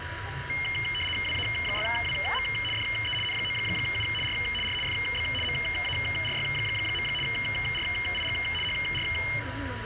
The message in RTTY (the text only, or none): WA6WM DE N9U R R FB MARY. RIG HR